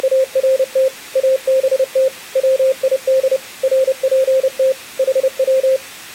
Morse code, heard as a keyed tone, machine-sent, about 30 wpm, 530 Hz. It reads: … ABT WID RPT HW